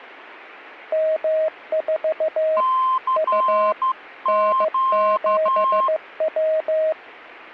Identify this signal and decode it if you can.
Morse code, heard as two keyed tones. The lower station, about 15 wpm, 630 Hz: M4 U N7W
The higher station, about 12 wpm, 1050 Hz: CQ